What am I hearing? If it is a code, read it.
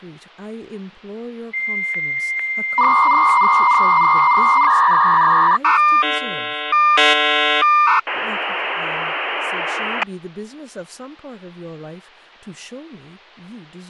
Dial-up modem handshake (V.34 or later), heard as a whistle, warbles, then hiss, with speech in English.